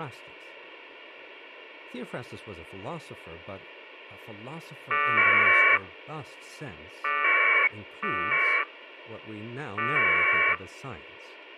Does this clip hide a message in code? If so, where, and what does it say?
Yes: packet radio (AX.25, as in APRS), 1200 baud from 4.9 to 10.6 s, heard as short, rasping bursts, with a squelch burst at the end and speech in English.